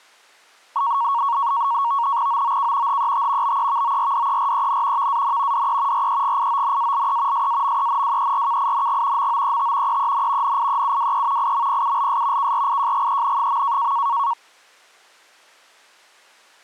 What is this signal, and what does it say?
NAVTEX (SITOR-B), 100 baud, 170 Hz shift, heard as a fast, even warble, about 1020 Hz centre. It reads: OOK HET BEVORDEREN VAN DE REGIONALE SAMENWERKING MOET EEN NIEUWE IMPULS KRIJGEN.